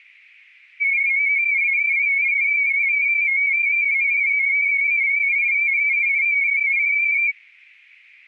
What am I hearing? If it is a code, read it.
Multi-tone FSK (Olivia or MFSK type), about 250 Hz wide, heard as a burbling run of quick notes, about 31.25 baud.